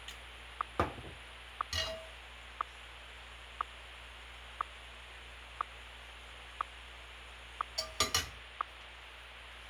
Radio time signal (WWVH, Hawaii), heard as ticks, one a second, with radio static and kitchen noise.